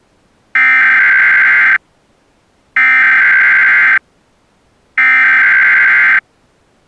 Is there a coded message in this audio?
Yes: Emergency Alert System (SAME) tones (header bursts) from 0.6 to 6.2 s, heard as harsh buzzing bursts, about 520.83 baud.